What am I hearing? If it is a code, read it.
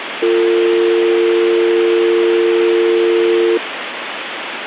Telephone call progress tone (North American or UK plan), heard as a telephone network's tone, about 350, 450 Hz, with phone line noise. Dial tone.